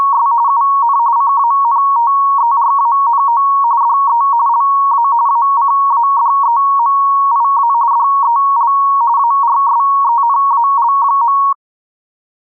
RTTY (45.45 baud, 170 Hz shift), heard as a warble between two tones, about 1020 Hz centre. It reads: … UN CANTERANO DE LA ACADEMIA DEL ARSENAL.